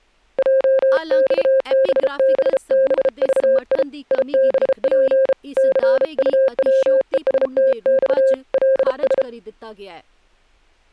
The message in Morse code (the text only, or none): JXBBBVI IBP CUWESTX LS